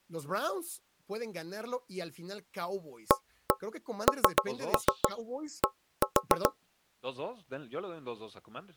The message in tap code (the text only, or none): AND